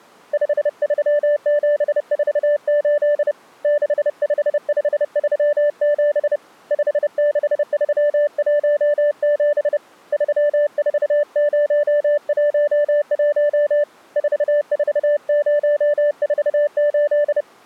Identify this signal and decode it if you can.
Morse code, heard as a keyed tone, hand-sent with a paddle, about 30 wpm, 590 Hz. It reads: 53748 65537 56317 34011 44048